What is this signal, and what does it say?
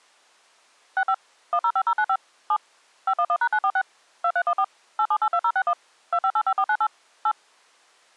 DTMF, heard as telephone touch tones, dialled by machine, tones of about 60 ms. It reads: 65 105095 7 511#946 2314 8782061 2585498 8